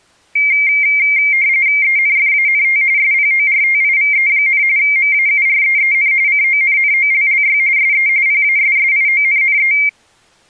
RTTY (45.45 baud, 170 Hz shift), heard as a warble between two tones, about 2200 Hz centre. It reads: ENFANT SPORTIVE, MAUREEN CONNOLLY SE PASSIONNE